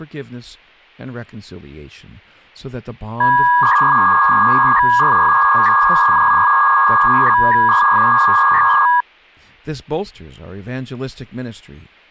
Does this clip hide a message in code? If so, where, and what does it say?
Yes: 300-baud modem data (V.21 tones) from 3.2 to 9.0 s, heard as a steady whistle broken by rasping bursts, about 300 baud, 200 Hz shift, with speech in English.